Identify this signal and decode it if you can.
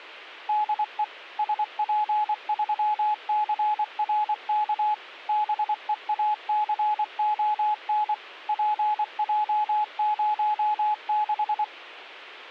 Morse code, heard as a keyed tone, machine-sent, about 24 wpm, 850 Hz. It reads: DE SP3CRK BEACON PJ06